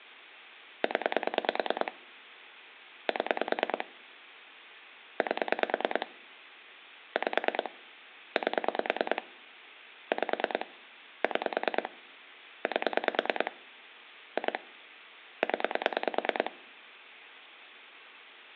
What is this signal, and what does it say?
Pulse dialling, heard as clicks on a phone line, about 9 pulses a second. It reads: 0 7 8 5 8 5 6 8 2 0